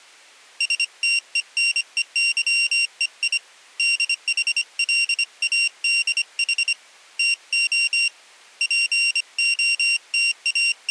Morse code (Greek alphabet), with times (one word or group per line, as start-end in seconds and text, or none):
0.6-3.4 ΣΤΕΝΕΥΕΙ
3.8-6.7 ΔΗΛΑΔΗ
7.2-8.1 ΤΟ
8.6-10.9 …